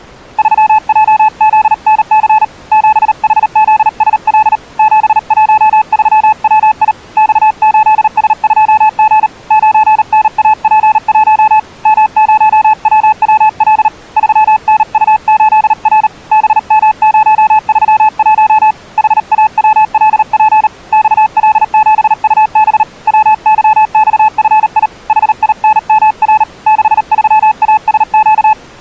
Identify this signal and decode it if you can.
Morse code, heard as a keyed tone, hand-sent with a paddle, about 38 wpm, 860 Hz. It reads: 3JZNC 7HZSL 713WI X8S2G 9NAP1 M0WWL 3NU8R BM031 HAWLP XL7UB WYXFI HINMR 63ASQ